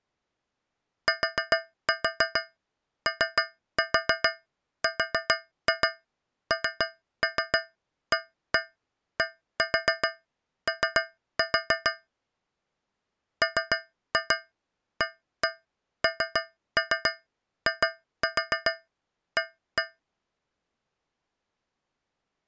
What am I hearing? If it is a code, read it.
Tap code, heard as taps on a metal pipe, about 6 knocks a second. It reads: TORNADO MANIA